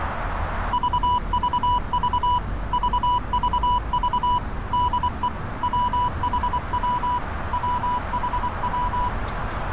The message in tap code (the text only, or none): none